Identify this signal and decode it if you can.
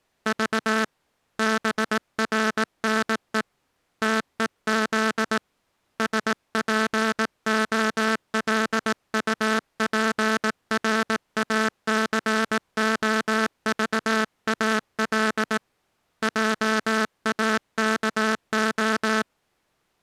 Morse code, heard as a buzzer, hand-sent with a paddle, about 18 wpm. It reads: V BRNE TEZ SPOLUPRACOVAL JAKO